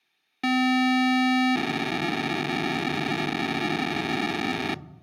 POCSAG pager data (512 baud), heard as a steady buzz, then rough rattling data.